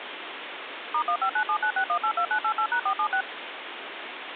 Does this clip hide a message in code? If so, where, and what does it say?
Yes: DTMF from 0.9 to 3.2 s, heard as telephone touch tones, dialled by machine, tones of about 80 ms, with phone line noise. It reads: *159796182988#476